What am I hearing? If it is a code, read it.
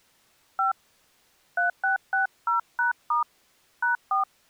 DTMF, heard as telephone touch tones, dialled by hand, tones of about 130 ms. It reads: 5 3660#* #4